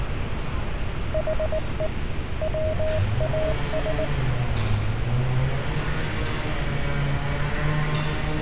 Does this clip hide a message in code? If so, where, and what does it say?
Yes: Morse code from 1.1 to 4.1 s, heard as a keyed tone, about 19 wpm, 630 Hz, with radio static and street noise. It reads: HE WAS